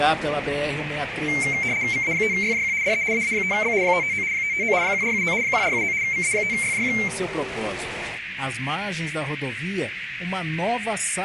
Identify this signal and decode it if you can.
RTTY (75 baud, 170 Hz shift), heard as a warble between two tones, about 2200 Hz centre, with radio static and a narrow filter. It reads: VA5YJQ DE AA5B 559 559 1479 1479 VA5YJQ